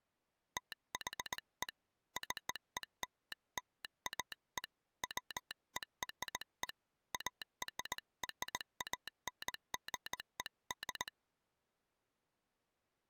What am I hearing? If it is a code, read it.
Morse code (American railroad code), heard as a telegraph sounder, hand-sent with a straight key. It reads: THE CELLAE WERE ARRANGED